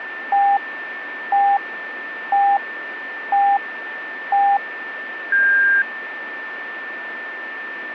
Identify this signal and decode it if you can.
Radio time signal (five pips and a higher one, as on Chinese radio), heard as pips, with radio static and a steady whistle near 1780 Hz.